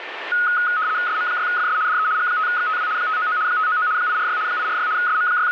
RTTY (75 baud, 170 Hz shift), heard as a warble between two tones, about 1360 Hz centre, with radio static and a steady whistle near 1790 Hz. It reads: SM6FS DE G5XTW 599 599 846 846 …